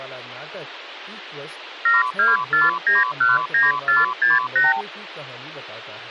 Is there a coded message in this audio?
Yes: multi-frequency trunk signalling (R2, with the far end's replies) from 1.9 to 4.8 s, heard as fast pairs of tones, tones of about 170 ms, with phone line noise and speech in Hindi. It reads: 724919468